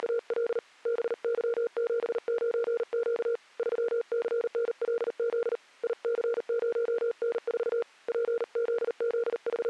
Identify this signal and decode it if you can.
Morse code, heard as a keyed tone, hand-sent with a paddle, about 39 wpm, 470 Hz. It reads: … BY79Q 3CNLZ IC0N4 …